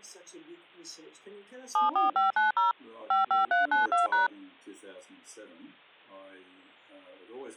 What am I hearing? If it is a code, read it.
DTMF, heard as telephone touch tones, dialled by machine, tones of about 140 ms. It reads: 74590 55392#